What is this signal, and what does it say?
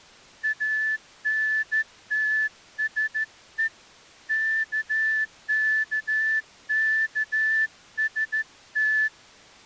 Morse code, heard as a whistle, hand-sent with a straight key, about 14 wpm. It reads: ANTSE KKKST